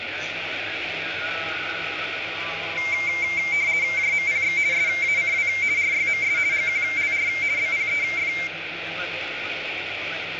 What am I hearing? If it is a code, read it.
RTTY (50 baud, 170 Hz shift), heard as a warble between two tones, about 2200 Hz centre, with radio static and room echo. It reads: JMPX SACW RYMS GQLR BPEF